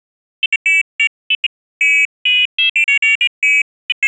Pairs of high tones at irregular times. There is no code.